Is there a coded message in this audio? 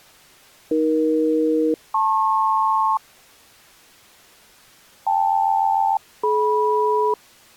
Yes: aircraft SELCAL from 0.7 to 7.1 s, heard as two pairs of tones. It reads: AE-LP KL-DM